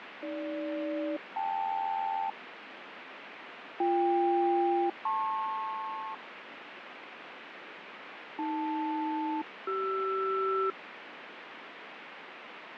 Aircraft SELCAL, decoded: AG-KL BK-LP AL-CR

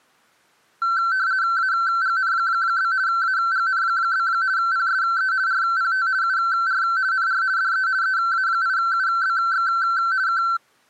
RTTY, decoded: AGN? AGN? PSE RPT UR NR DE EA8UBX K

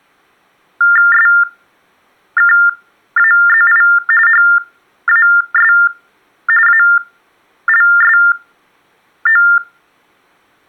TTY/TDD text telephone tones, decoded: SKAZI HAS ALSO

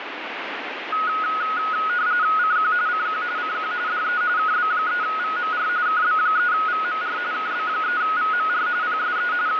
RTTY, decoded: CQ CQ CQ DE KB3VMR KB3VMR KB3VMR PSE …

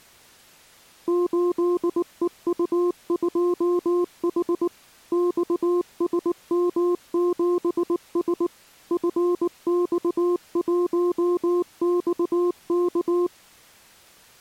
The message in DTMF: none

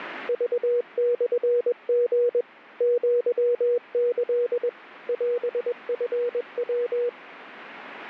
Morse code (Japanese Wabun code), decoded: クモリ アキ オチヤ

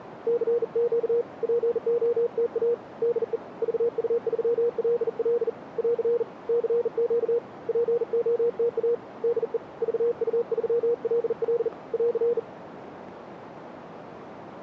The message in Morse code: CQ POTA DE VU3LL <AR> CQ POTA DE VU3LL <AR>

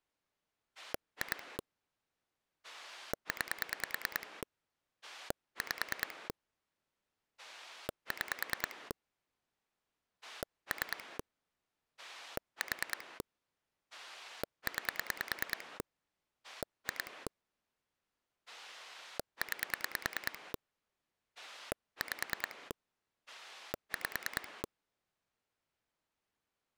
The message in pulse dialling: 2 9 5 6 3 4 9 2 9 5 5

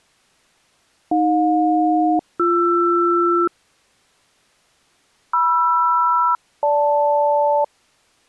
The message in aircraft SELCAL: AJ-BR MR-GL

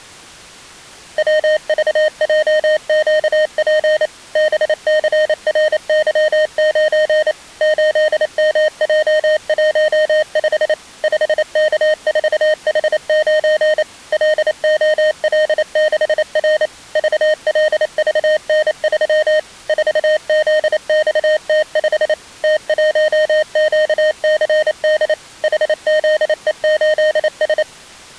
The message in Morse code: WVJQP BCRY9 8MJ15 5K4H9 LOL6R VLVN3 4ZXT5 T1QCD HZE8S

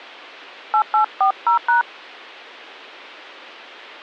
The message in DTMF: 8840#

